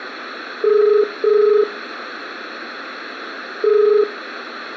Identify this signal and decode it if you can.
Telephone call progress tone (as in the UK, Ireland, Australia and similar networks), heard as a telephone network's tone, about 430 Hz, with phone line noise and room echo. Ringback tone.